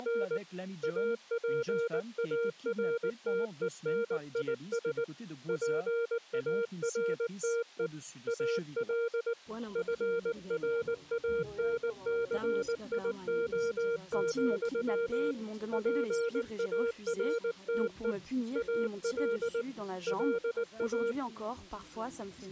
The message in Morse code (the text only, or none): … APARTENIS PARTE AL FRANCIO, PARTE AL LA